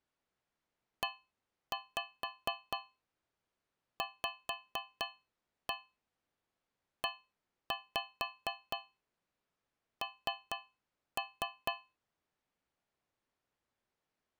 Tap code, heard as taps on a metal pipe, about 4 knocks a second. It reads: EVEN